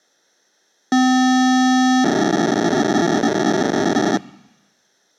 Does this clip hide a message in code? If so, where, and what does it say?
Yes: POCSAG pager data (512 baud) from 0.9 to 4.2 s, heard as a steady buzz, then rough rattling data.